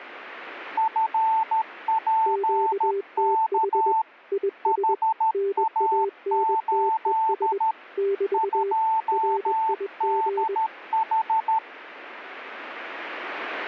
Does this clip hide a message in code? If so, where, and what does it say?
Yes: Morse code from 0.7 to 11.6 s, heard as two keyed tones. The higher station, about 13 wpm, 890 Hz: FPK HA8 2DH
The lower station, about 21 wpm, 400 Hz: QTH IS NANTES <BT> RIG